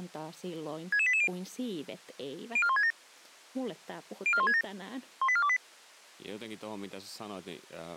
Five-tone selective call (ZVEI), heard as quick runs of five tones, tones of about 70 ms, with speech in Finnish. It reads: 66880 04167 04167 18428